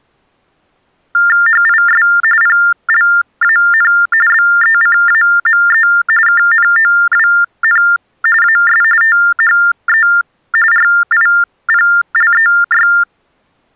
TTY/TDD text telephone tones (45.45 baud Baudot), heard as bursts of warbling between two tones, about 400 Hz shift, 1600 Hz centre. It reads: HIS PLAN BECAME KNOWN AS THE RIPLEY